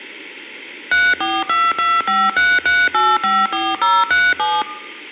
DTMF, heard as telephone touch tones, dialled by machine, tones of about 220 ms. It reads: 3422533854037